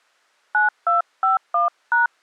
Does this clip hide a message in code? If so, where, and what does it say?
Yes: DTMF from 0.5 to 2.1 s, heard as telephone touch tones, dialled by hand, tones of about 140 ms. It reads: 9251#